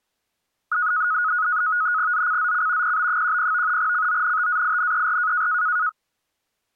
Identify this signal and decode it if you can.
NAVTEX (SITOR-B), 100 baud, 170 Hz shift, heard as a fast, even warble, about 1360 Hz centre. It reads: ZCZC PB10 CONTAINER